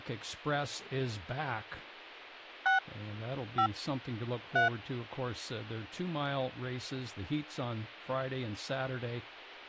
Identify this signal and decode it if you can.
DTMF, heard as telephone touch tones, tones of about 110 ms, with speech in English. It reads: 6 5 3